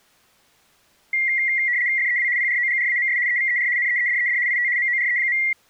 RTTY (75 baud, 170 Hz shift), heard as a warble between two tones, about 2050 Hz centre. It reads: FEW PROGRAMS EVER NEEDED IT MORE.